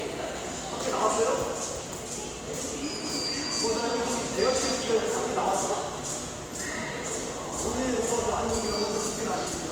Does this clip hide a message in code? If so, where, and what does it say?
No, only the noise of a subway station.